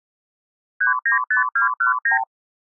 Multi-frequency trunk signalling (R2, with the far end's replies), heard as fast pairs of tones, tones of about 120 ms. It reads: 395219